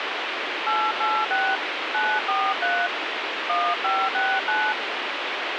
DTMF, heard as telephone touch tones, dialled by hand, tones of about 250 ms, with radio hiss. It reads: 886 943 1569